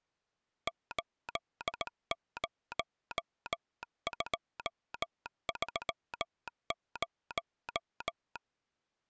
Morse code, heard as a telegraph sounder, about 18 wpm. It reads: 80230